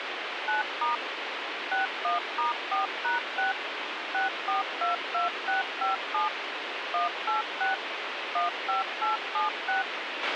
DTMF, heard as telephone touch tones, dialled by machine, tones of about 140 ms, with radio hiss and a squelch burst at the end. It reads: 9* 61*4#6 6422657 186 15876